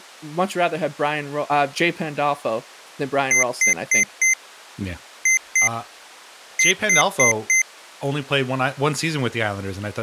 Beep code, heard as beeps from a small speaker, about 2050 Hz, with speech in English. 4-2-4. In Phoenix BIOS tables: unexpected interrupt in protected mode.